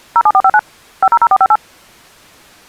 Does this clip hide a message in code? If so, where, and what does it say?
Yes: DTMF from 0.2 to 1.6 s, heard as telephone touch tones, dialled by machine, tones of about 50 ms. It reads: 07459 500458